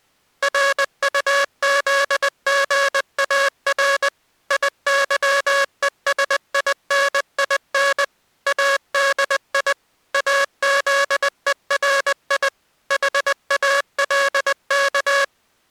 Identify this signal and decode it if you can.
Morse code, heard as a buzzer, machine-sent, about 20 wpm. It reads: RUZGAR IYESININ ADI AZERI HALK